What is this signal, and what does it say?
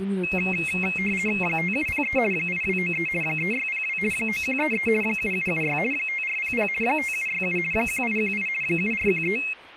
RTTY (50 baud, 450 Hz shift), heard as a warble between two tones, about 2350 Hz centre, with speech in French. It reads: 5703 8293 3602 9133 7776 5400 5767 1818 7413